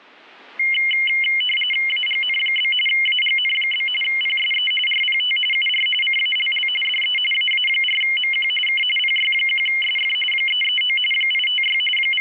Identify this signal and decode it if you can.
RTTY (45.45 baud, 850 Hz shift), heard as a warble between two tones, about 2550 Hz centre. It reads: AGN? AGN? PSE RPT UR CALL DE AA4MQ K PY1SF 339 856 …